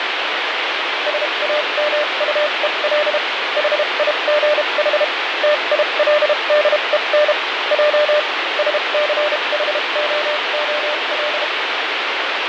Morse code, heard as a keyed tone, machine-sent, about 32 wpm, spaced as for 27 wpm, 600 Hz, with heavy radio static and fading. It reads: SAMUEL HIGH TILDEN J SCHOOL